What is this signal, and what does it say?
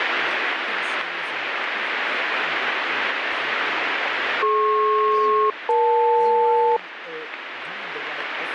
Aircraft SELCAL, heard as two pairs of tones, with radio static and speech in English. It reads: DP-EL